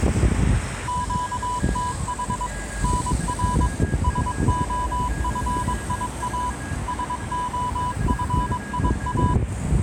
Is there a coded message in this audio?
Yes: Morse code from 0.8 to 9.4 s, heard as a keyed tone, machine-sent, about 22 wpm, 990 Hz, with a weaker station near 1640 Hz and street noise. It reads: QTH NR SOFIA SOFIA